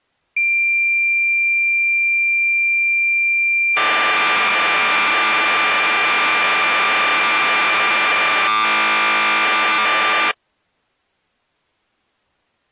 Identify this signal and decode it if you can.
Cassette data (Kansas City type), 1200 baud, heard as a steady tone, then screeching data.